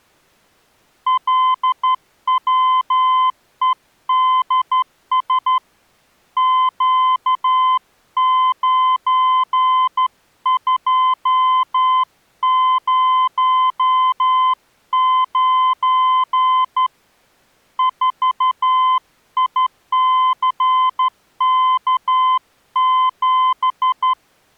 Morse code, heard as a keyed tone, hand-sent with a straight key, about 12 wpm, 1030 Hz. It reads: LWEDS Q9209 4ICK7